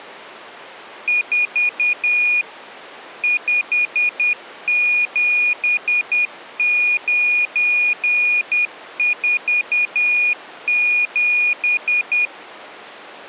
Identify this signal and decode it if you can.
Morse code, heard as a high beeper, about 10 wpm, 2450 Hz. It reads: 4 57947